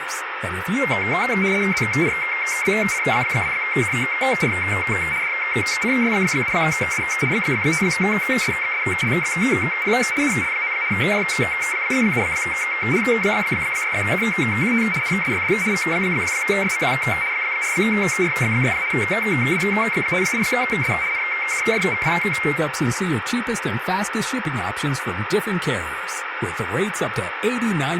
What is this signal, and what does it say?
RTTY (75 baud, 170 Hz shift), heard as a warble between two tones, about 2200 Hz centre, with radio static and speech in English. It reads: ZNBC2KR DCY7U 5SXSLXP UL9 J7H6KQT NSYD V1YMQ 4R6 W58S NKJVW